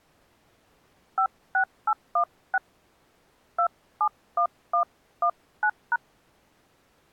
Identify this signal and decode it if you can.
DTMF, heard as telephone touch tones, dialled by hand, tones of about 70 ms. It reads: 56816 271119#